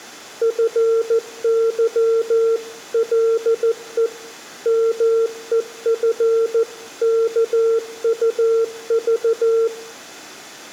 Morse code (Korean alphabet), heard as a keyed tone, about 14 wpm, 450 Hz, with room echo. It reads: 네가 만일